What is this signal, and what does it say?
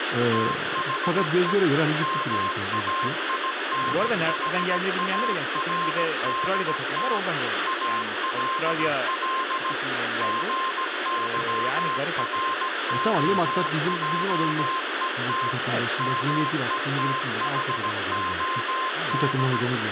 Morse code, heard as a keyed tone, machine-sent, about 17 wpm, 1050 Hz, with radio static, room echo and speech in Turkish. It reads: THE MAINHARDT ALL GYROJET METHOD